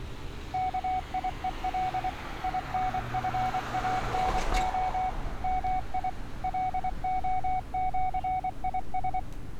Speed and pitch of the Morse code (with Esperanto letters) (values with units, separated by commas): 24 wpm, 750 Hz